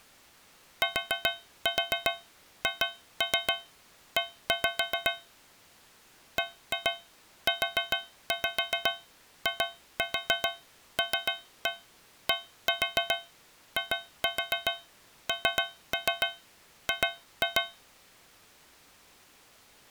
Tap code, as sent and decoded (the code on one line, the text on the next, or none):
4-4 2-3 1-5 / 1-2 4-5 2-4 3-1 1-4 2-4 3-3 2-2
THE BUILDING